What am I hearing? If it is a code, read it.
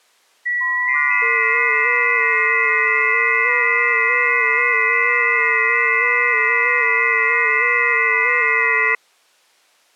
FT8 (several signals at once), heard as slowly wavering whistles, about 6.25 baud.